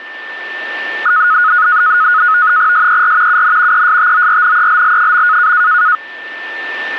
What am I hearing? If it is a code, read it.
NAVTEX (SITOR-B), 100 baud, 170 Hz shift, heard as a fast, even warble, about 1360 Hz centre, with a steady whistle near 1780 Hz. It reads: SER UN ESTORNELL.